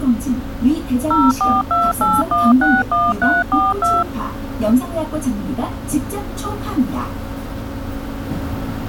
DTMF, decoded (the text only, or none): 0428161342